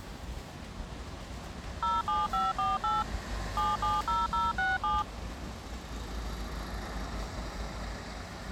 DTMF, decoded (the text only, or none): 07548 770067